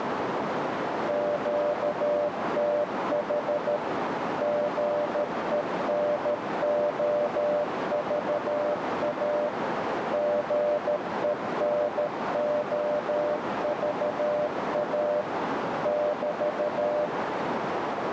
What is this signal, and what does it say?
Morse code, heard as a keyed tone, machine-sent, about 13 wpm, 590 Hz, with heavy radio static and a narrow filter. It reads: QTH GENOVA GENOVA <BT>